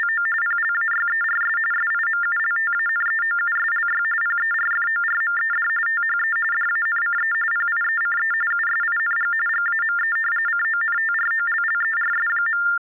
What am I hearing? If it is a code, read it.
TTY/TDD text telephone tones (45.45 baud Baudot), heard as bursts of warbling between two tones, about 400 Hz shift, 1600 Hz centre. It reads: … PLAYERS SIMULTANEOUSLY PERFORMED THE DANCE PIECE USING GAME CONTROLLERS.